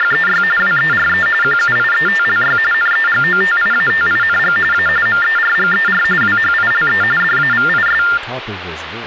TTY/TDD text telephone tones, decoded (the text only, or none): … WERE QUIETLY NEGOTIATING A MERGER WHILE DAVIS